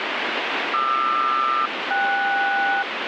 Aircraft SELCAL, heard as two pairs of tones, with radio static. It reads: QR-KS